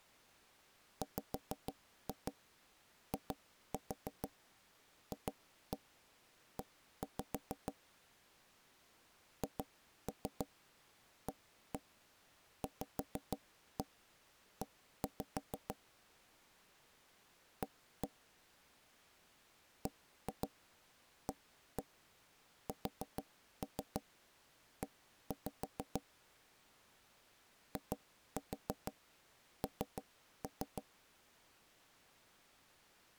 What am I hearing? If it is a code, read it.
Tap code, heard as knocks on wood, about 6 knocks a second. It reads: WIFE HAVE A BASE IN